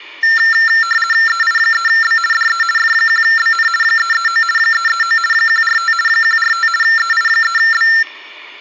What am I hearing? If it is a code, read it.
RTTY (50 baud, 450 Hz shift), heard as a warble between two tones, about 1600 Hz centre. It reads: EI3B DE F1BN 339 339 145 145 EI3B